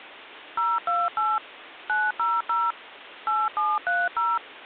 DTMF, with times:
0.6-1.4 028
1.9-2.7 900
3.3-4.4 8730

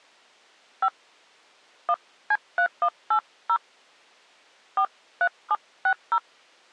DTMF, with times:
0.8-0.9 5
1.9-3.6 1C3180
4.8-6.2 43760

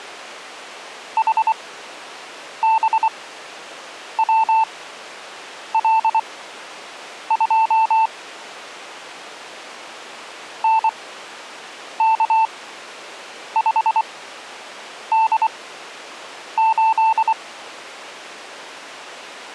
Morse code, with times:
1.2-8.1 HBWL2
10.6-17.3 NK5D8

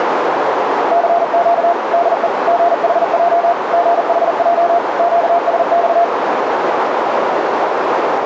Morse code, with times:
0.9-1.7 CQ
1.9-2.3 DE
2.5-3.5 GHJ
3.7-4.8 GHJ
5.0-6.0 QSX

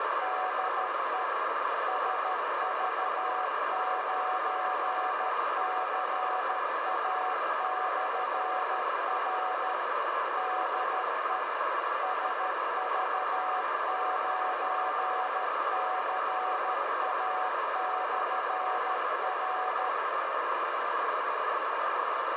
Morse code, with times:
0.2-1.2 DE
1.9-9.7 SV9CA/R
10.4-11.4 DE
12.0-19.9 SV9CA/R

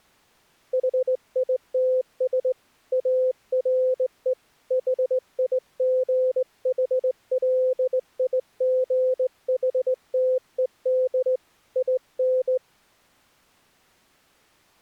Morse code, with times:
0.7-2.5 HITS
2.9-4.3 ARE
4.7-11.4 HIGHLIGHTED
11.8-12.6 IN

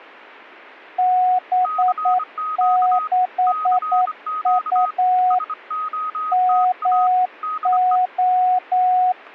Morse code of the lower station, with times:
1.0-5.4 B6U
6.3-9.1 MO

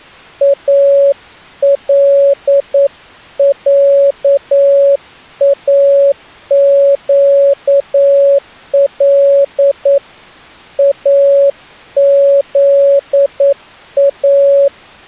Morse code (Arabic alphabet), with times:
0.4-10.0 العاقل
10.8-14.7 اذا

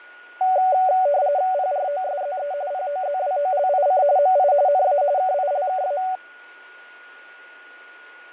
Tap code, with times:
none

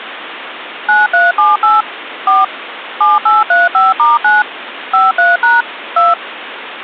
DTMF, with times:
0.9-1.8 9378
2.3-2.4 4
3.0-4.4 7835*9
4.9-5.6 53#
6.0-6.1 2

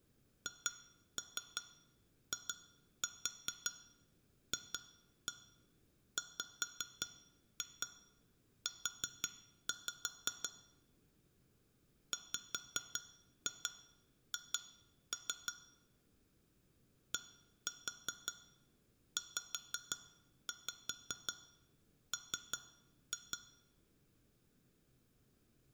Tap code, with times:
0.5-10.5 HIFWU
12.1-15.5 WH
17.1-23.4 DZM

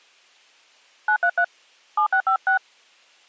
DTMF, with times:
1.1-1.4 933
2.0-2.6 7656

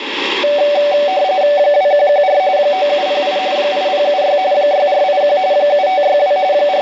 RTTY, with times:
1.6-2.4 2114
2.6-3.4 9708
3.6-4.4 8076
4.5-5.4 6481
5.5-6.4 7562
6.5-6.8 …

